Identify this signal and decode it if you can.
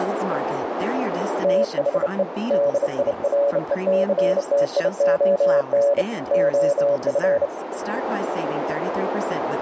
Morse code, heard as a keyed tone, hand-sent with a bug key, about 29 wpm, 570 Hz, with radio static, a narrow filter and speech in English. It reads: THE DIRECTION OF